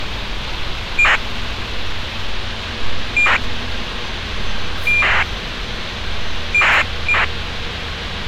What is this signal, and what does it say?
ACARS aircraft data, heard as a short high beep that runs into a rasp, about 2400 baud, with radio hiss and street noise.